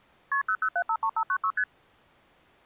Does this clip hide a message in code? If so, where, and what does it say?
Yes: multi-frequency trunk signalling (R1, as on North American trunks) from 0.3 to 1.6 s, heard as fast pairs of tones, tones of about 70 ms. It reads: KP 00753596 ST